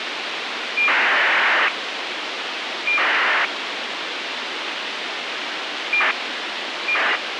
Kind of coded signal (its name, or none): ACARS aircraft data